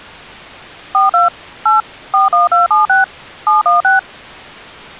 DTMF, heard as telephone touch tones, dialled by machine, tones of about 150 ms. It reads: 42 8 41276 716